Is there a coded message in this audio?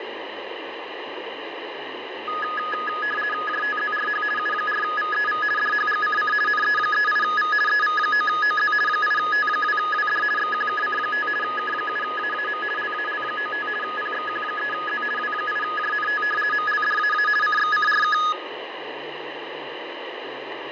Yes: RTTY (50 baud, 450 Hz shift) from 2.3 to 18.3 s, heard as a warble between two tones, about 1460 Hz centre, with radio static and fading. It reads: JTZRH U4VEV DHGCC NE38V EV9OZ 8T2WD XQKC5 K7AAM LAL95 PXQ3Z W8JNT MLDAA CXCRK